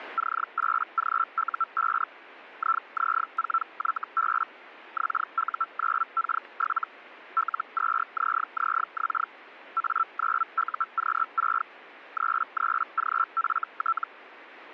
Hellschreiber (Feld-Hell, 122.5 baud), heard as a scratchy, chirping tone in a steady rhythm, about 1340 Hz. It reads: C8GU5 IZ4YB XU9K7 L2ZZX A9UQ6 33GFT